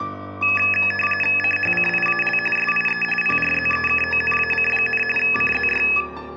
RTTY (45.45 baud, 850 Hz shift), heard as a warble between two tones, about 2150 Hz centre. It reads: CHCIAL SIE PRZEKONAC, CZY